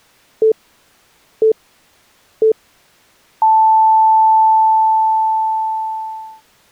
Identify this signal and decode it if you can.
Radio time signal (three low pips and a long one an octave up, as on NHK), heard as pips.